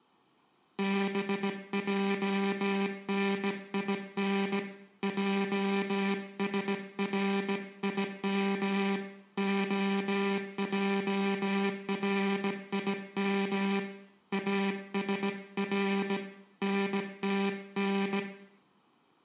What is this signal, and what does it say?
Morse code (Hebrew alphabet), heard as a buzzer, hand-sent with a bug key, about 17 wpm, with room echo. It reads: בענין עשרים הערים אשר נתן